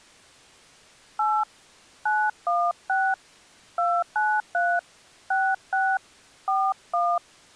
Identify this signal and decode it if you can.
DTMF, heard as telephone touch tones, dialled by hand, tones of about 250 ms. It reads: 8 916 293 66 41